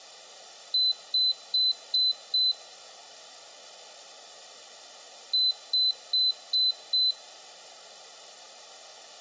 Beep code, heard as a piezo beeper, played twice, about 4050 Hz. 5 short. In AMI BIOS tables: processor failure; in Dell tables: CMOS battery failure.